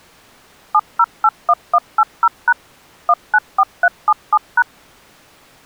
DTMF, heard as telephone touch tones, dialled by machine, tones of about 50 ms. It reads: 7081180# 194377#